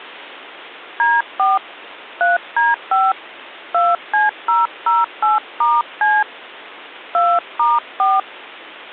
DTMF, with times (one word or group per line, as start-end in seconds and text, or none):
1.0-1.6 D4
2.2-3.1 3D5
3.7-6.2 2C008*C
7.1-8.2 2*4